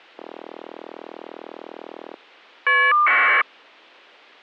Caller ID data burst, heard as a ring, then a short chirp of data, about 1200 baud.